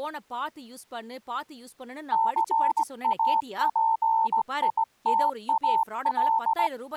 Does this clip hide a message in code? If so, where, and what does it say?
Yes: Morse code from 2.1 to 6.7 s, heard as a keyed tone, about 17 wpm, 900 Hz, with speech in Tamil. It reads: CAPITAL